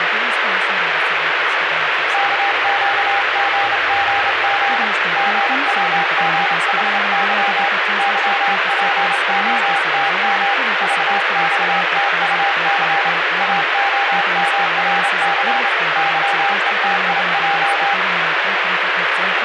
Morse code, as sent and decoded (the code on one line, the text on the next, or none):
-.- --.- --. --. --. / --. .-- --. .... -.-- / -.-- .--. --- - -- / ...- -..- - ..- -.-. / .- --- -- .-. -.-. / -.-- . - .. .---
KQGGG GWGHY YPOTM VXTUC AOMRC YETIJ